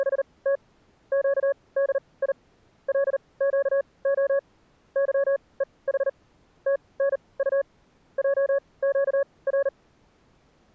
Morse code, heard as a keyed tone, machine-sent, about 39 wpm, spaced as for 24 wpm, 560 Hz. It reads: … QDI LQO YEH TNU JQR